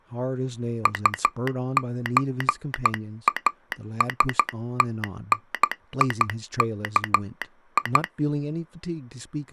Morse code (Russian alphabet), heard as a telegraph sounder, hand-sent with a straight key, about 12 wpm, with speech in English. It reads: УЧАСТНИКИ